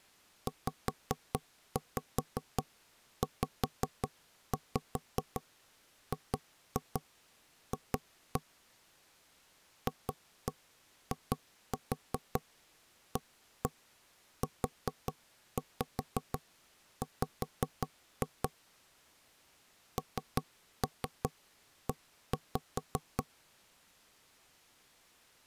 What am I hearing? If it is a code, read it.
Tap code, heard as knocks on wood, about 5 knocks a second. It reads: ZZGF FIAUW NE